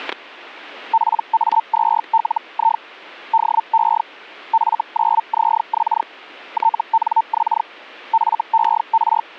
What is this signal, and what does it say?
Hellschreiber (Feld-Hell, 122.5 baud), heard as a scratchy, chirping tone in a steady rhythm, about 900 Hz, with static crashes. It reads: PA2LI DE F9ZX TNX FER